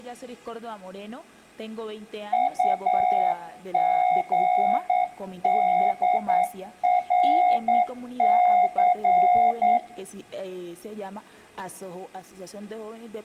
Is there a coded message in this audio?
Yes: Morse code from 2.3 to 9.8 s, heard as a keyed tone, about 9 wpm, 730 Hz, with room echo. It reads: UGDRC